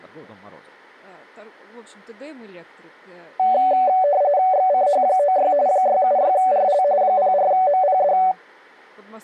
RTTY (45.45 baud, 170 Hz shift), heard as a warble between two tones, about 660 Hz centre, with speech in Russian. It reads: XCH96 676RL 04MPD